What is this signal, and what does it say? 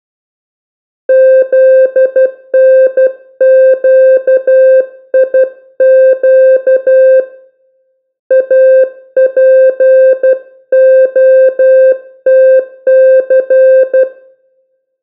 Morse code (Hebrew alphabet), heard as a keyed tone, hand-sent with a paddle, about 12 wpm, 520 Hz, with room echo. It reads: זנקיק אפהתס